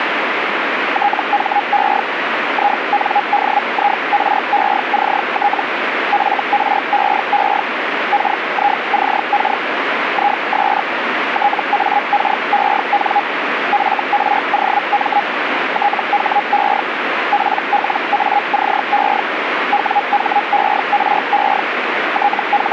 Hellschreiber (Feld-Hell, 122.5 baud), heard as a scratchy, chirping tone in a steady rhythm, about 820 Hz, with radio static. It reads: THE INDIRECT FREE KICK IS TAKEN FROM THE PLACE WHERE …